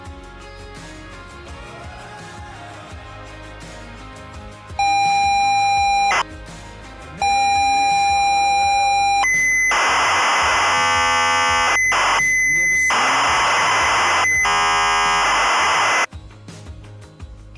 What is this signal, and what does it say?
ZX Spectrum tape loading, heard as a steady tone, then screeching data.